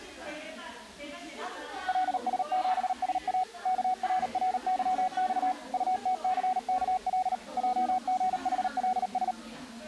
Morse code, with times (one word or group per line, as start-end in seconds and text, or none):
1.9-3.4 LS7SA
3.7-5.5 KRRYX
5.7-7.3 UTCKL
7.6-9.3 JGHLS